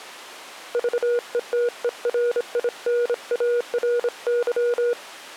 Morse code, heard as a keyed tone, hand-sent with a bug key, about 26 wpm, 480 Hz. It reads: VETERINARY